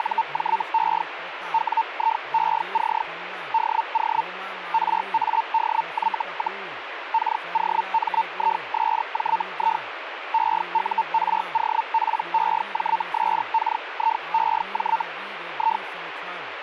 Hellschreiber (Feld-Hell, 122.5 baud), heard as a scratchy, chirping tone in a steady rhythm, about 900 Hz, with radio static and speech in Maithili. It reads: … WIEC DO RADY, KOMISJI EUROPEJSKIEJ I